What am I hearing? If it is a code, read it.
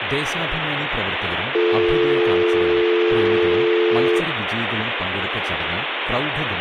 Telephone call progress tone (North American or UK plan), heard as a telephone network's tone, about 350, 440 Hz, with phone line noise and speech in Malayalam. Dial tone.